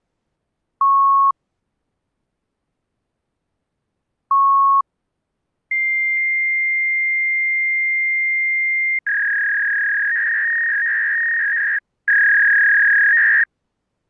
Fax machine handshake, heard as beeps, a long tone and a warble.